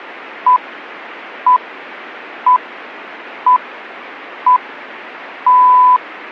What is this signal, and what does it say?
Radio time signal (six pips, as the Greenwich Time Signal), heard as pips.